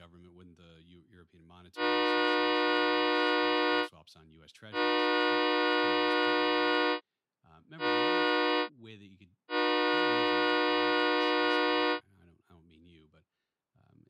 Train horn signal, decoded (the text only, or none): 2 long, 1 short, 1 long